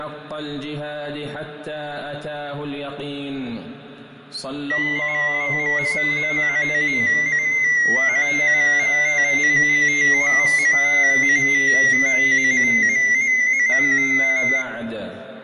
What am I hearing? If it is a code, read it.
Multi-tone FSK (Olivia or MFSK type), about 250 Hz wide, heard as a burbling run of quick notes, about 15.625 baud, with fading and room echo.